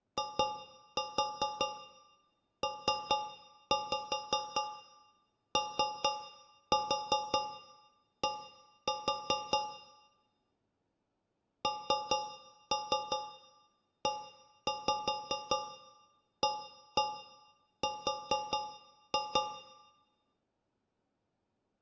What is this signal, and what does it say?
Tap code, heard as taps on a metal pipe, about 5 knocks a second, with room echo. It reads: IPOD NEAR